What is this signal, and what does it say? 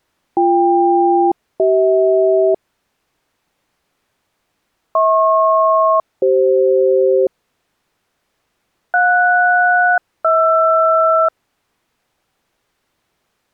Aircraft SELCAL, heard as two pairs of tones. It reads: BK-CH HP-CF JS-HR